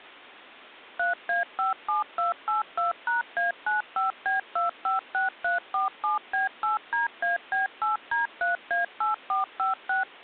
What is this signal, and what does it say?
DTMF, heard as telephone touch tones, dialled by machine, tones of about 140 ms. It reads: 3A57282#A95B256347B8DAB8D3A8456